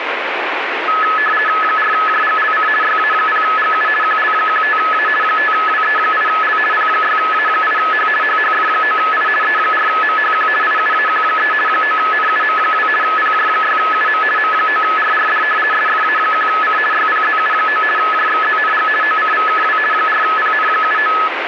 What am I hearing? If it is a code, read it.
RTTY (50 baud, 450 Hz shift), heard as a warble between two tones, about 1500 Hz centre, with radio static. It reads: 4JGLC YA0GU QL15A 5WE8L P6A8H HHF9I E4MHQ IUAQ3 9NUM2 PJ6UM M9RRD SFA1C YPZU9 JXZNG OCVKW 4PN79